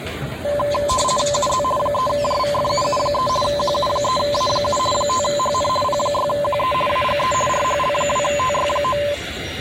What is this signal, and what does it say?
RTTY (50 baud, 450 Hz shift), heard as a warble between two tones, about 800 Hz centre, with the noise of a residential street. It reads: UZ 3JVFUU3 QU3A7 5HN P6QE AGE RHL2TY9